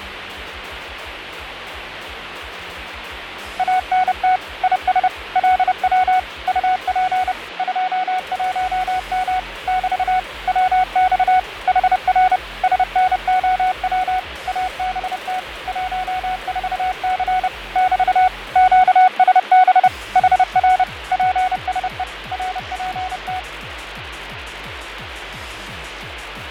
Morse code, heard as a keyed tone, machine-sent, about 30 wpm, 740 Hz, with radio static and fading. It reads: ANT IS LW UP 21M <BT> WX HR SNOW ABT 14C <BT> QSB HR PSE RPT